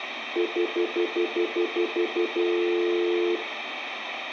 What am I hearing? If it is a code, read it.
Telephone call progress tone (North American plan), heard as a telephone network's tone, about 350, 440 Hz, 0.1 s on and 0.1 s off, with phone line noise and room echo. Stutter dial tone.